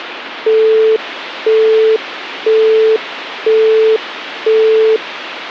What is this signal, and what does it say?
Telephone call progress tone (single-tone plan, as in Europe, Japan and elsewhere), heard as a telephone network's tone, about 440 Hz, 0.5 s on and 0.5 s off, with phone line noise. Busy tone.